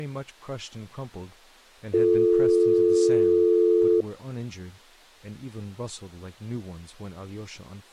Telephone call progress tone (North American or UK plan), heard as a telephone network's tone, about 350, 440 Hz, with speech in English. Dial tone.